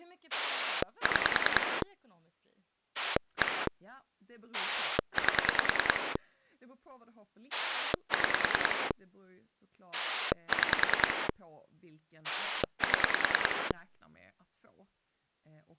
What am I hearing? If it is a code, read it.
Pulse dialling, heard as a rotary dial, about 10 pulses a second, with speech in Swedish. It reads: 6 1 8 6 6 7